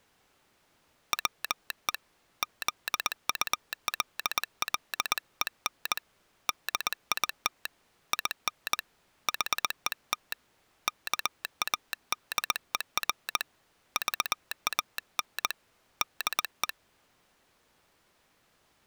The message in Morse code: WE ZULLEN DIT IN HET KADER VAN DE

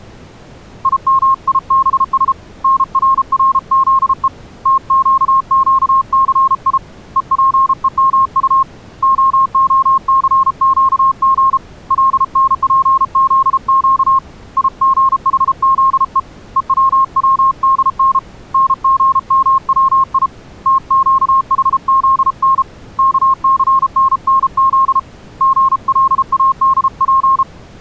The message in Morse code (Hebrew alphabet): ימיבש נררזו תקקסי ופומט ההסקג לנפזק יגחזו וצצדן נגמצי תקחזן כסננז גלאדף

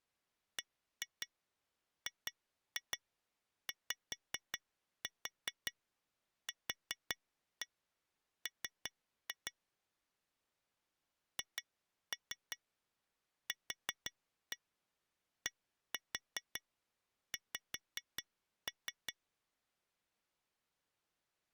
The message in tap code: BGYQM HQDX

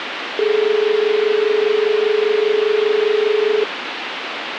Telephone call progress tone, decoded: dial tone

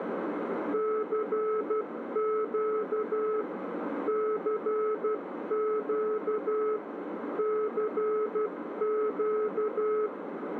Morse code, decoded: CQ CQ CQ

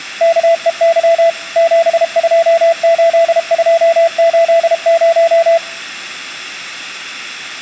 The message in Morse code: KEY 728280

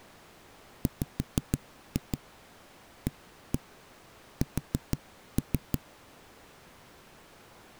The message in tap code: WAS

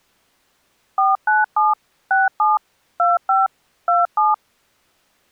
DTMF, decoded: 497 67 25 27

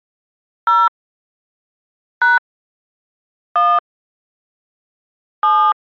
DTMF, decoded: 0 # 1 7

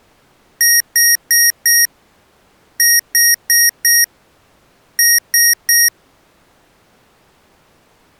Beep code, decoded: 4-4-3

